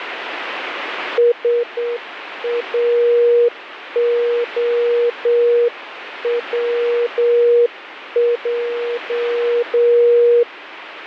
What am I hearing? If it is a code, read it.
Morse code, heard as a keyed tone, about 8 wpm, 480 Hz, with radio static. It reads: SAOWJ